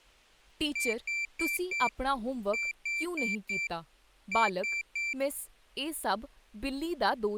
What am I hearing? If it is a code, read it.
Beep code, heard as a piezo beeper, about 2350 Hz, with speech in Punjabi. 4-4-3. In Phoenix BIOS tables: maths coprocessor failure.